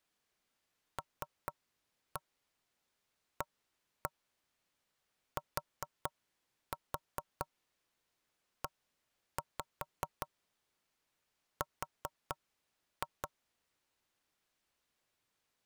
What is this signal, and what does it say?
Tap code, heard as knocks on wood, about 4 knocks a second. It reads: LATER